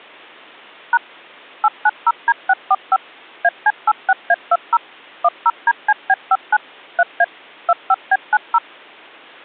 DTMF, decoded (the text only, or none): # 890D645 AC86A20 10DCB59 3A 25B90